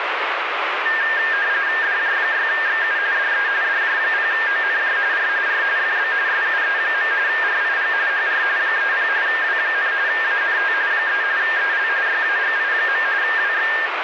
RTTY (45.45 baud, 170 Hz shift), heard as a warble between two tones, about 1700 Hz centre, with radio static. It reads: DJ6XU DE DJ0ONJ R R FB SUE. RIG HR 30 W, ANT 3 EL YAGI. WX